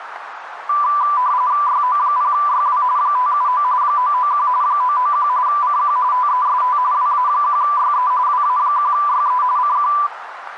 RTTY (45.45 baud, 170 Hz shift), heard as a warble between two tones, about 1080 Hz centre, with radio static and a narrow filter. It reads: YO0YW 579 991 991 CQ TEST WA1YE WA1YE CQ